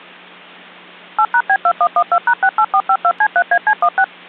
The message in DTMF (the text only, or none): 8#B2112#68452C3AC16